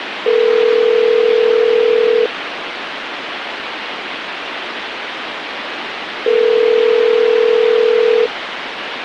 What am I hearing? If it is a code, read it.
Telephone call progress tone (North American plan), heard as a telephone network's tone, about 440, 480 Hz, 2 s on and 4 s off, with phone line noise. Ringback tone.